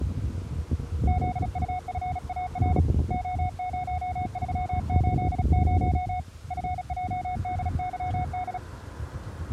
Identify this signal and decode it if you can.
Morse code, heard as a keyed tone, hand-sent with a paddle, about 36 wpm, 730 Hz, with street noise. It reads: ZUFAR O0380 FJDYD